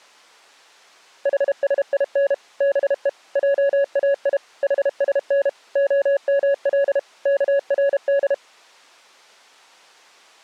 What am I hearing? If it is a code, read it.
Morse code (Persian alphabet), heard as a keyed tone, machine-sent, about 32 wpm, 560 Hz. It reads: حسین به جای حسن عمل کرد